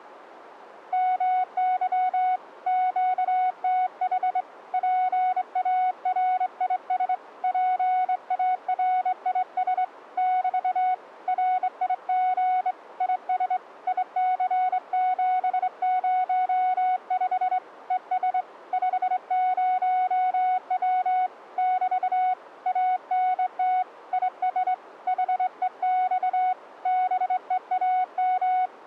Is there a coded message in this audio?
Yes: Morse code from 0.9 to 28.7 s, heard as a keyed tone, hand-sent with a straight key, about 24 wpm, 740 Hz. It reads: MY QTH PARIS PARIS <BT> RIG IS IC705 ES 50W <BT> ANT IS HEX BEAM